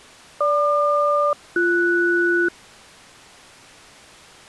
Aircraft SELCAL, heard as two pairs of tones. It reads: GQ-BS